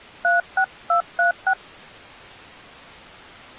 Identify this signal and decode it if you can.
DTMF, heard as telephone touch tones, dialled by hand, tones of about 110 ms. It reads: 36236